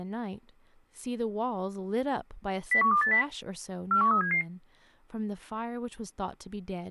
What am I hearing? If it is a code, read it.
Five-tone selective call (CCIR), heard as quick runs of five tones, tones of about 100 ms, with speech in English. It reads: 01280 41377